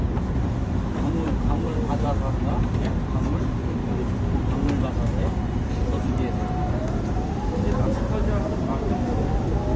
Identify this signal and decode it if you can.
The noise inside a subway train. There is no code.